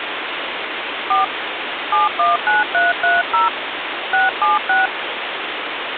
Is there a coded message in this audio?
Yes: DTMF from 1.1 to 4.9 s, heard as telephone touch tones, dialled by hand, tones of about 160 ms, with phone line noise. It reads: 4 719330 676